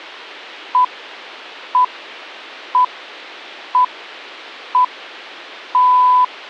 Radio time signal (six pips, as the Greenwich Time Signal), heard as pips.